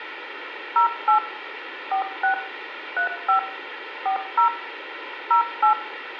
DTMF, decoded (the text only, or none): 08 46 35 40 08